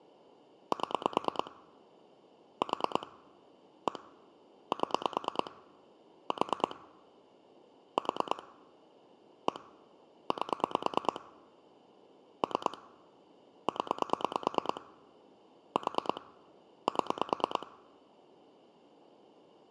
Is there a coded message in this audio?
Yes: pulse dialling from 0.7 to 17.6 s, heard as clicks on a phone line, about 9 pulses a second. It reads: 7 4 1 7 4 4 1 8 3 0 4 7